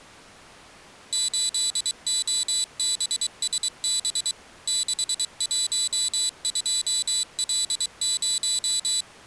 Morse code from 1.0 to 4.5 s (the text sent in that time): 8OBSB